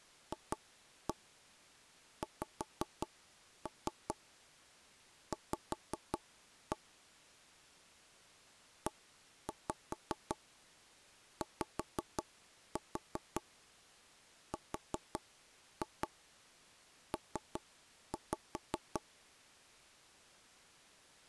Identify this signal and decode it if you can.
Tap code, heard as taps on a table, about 5 knocks a second. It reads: FXV EYRP